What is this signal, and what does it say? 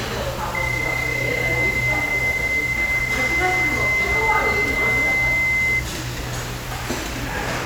PSK31 (31.25 baud), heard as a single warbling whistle, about 2050 Hz, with the noise of a restaurant.